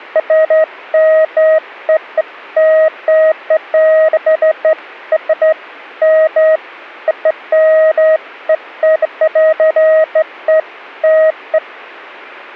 Beeps of irregular length. There is no code.